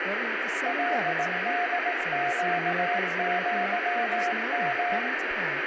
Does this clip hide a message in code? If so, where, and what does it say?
Yes: Morse code (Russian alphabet) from 0.6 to 5.1 s, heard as a keyed tone, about 18 wpm, 710 Hz, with radio static, room echo and speech in English. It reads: ЛДЩЪМ